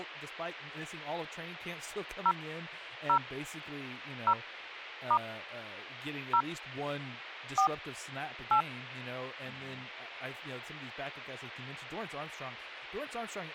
DTMF, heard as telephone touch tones, dialled by hand, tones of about 80 ms, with speech in English. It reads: 0 0 0 * 0 4 8